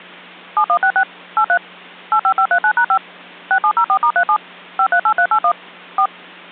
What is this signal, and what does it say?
DTMF, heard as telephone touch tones, dialled by machine, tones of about 80 ms. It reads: 7166 83 85539#5 6704*37 538381 4